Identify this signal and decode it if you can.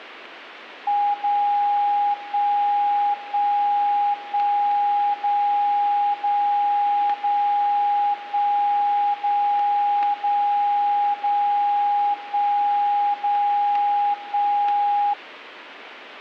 Radio time signal (DCF77), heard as a tone whose level steps once a second, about 820 Hz. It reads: 0 1 1 1 0 0 0 1 0 0 0 1 0 1